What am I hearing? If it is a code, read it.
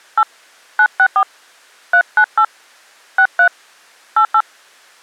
DTMF, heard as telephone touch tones, dialled by hand, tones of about 80 ms. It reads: 8 964 398 63 88